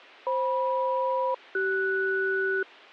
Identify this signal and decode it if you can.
Aircraft SELCAL, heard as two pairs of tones. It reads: FM-CS